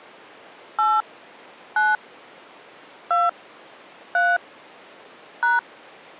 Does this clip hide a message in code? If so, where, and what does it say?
Yes: DTMF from 0.8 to 5.6 s, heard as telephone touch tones, dialled by hand, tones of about 210 ms. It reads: 8 9 2 3 #